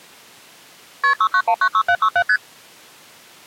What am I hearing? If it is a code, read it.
Multi-frequency trunk signalling (R1, as on North American trunks), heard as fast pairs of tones, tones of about 70 ms. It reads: KP 69196767 ST